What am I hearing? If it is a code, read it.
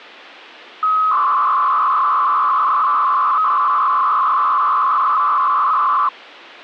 300-baud modem data (Bell 103 tones), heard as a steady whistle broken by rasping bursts, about 300 baud, 200 Hz shift.